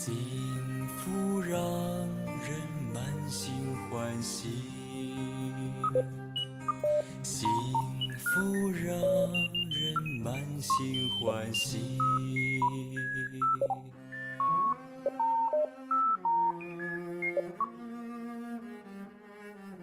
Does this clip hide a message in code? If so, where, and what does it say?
No, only electronic bleeps of random pitch and length, with room echo.